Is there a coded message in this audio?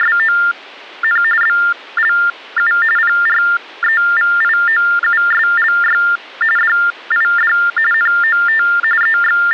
Yes: TTY/TDD text telephone tones (45.45 baud Baudot) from 0.0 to 9.5 s, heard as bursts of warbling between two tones, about 400 Hz shift, 1600 Hz centre. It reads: … BLU PREVIOUSLY DID NOT …